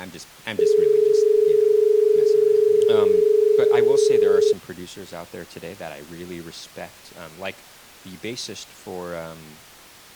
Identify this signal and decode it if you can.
Telephone call progress tone (as in Australia), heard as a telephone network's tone, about 430 Hz, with speech in English. Dial tone.